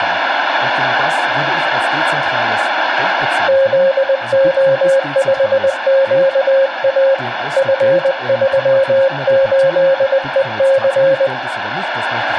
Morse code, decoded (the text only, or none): ZO5QA F38EC